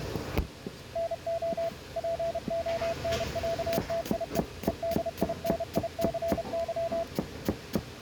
Morse code (Russian alphabet), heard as a keyed tone, machine-sent, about 31 wpm, 670 Hz, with kitchen noise. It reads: НО ПОНЯТИЕ ЕДИНИЦЫ